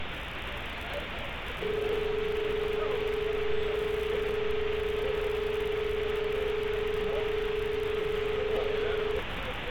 Telephone call progress tone (as in Australia), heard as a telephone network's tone, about 430 Hz, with phone line noise and street noise. Dial tone.